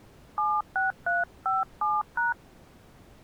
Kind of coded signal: DTMF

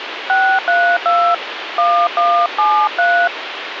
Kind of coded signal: DTMF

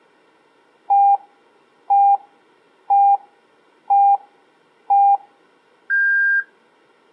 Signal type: radio time signal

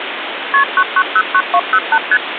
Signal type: multi-frequency trunk signalling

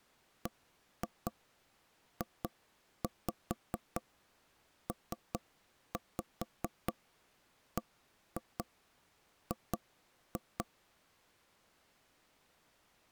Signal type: tap code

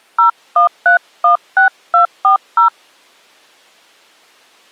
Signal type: DTMF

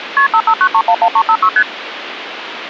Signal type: multi-frequency trunk signalling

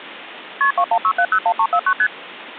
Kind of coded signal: multi-frequency trunk signalling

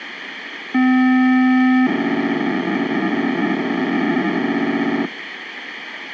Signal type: POCSAG pager data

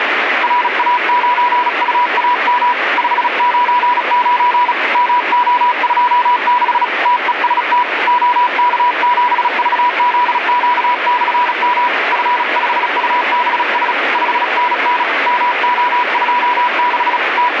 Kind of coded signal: Morse code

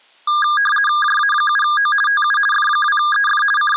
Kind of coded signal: RTTY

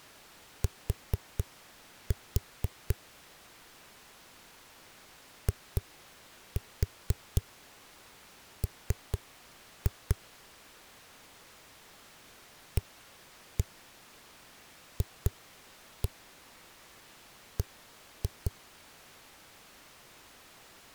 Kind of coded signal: tap code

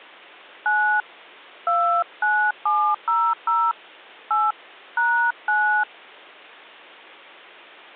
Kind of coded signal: DTMF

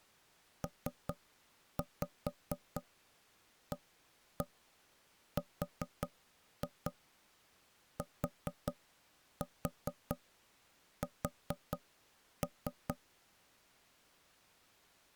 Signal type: tap code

